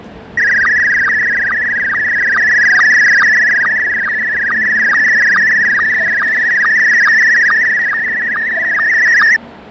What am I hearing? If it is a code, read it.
SSTV (slow-scan television), Scottie S1, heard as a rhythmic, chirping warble, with fading and the noise of a subway station.